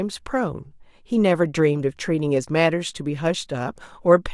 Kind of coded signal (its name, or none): none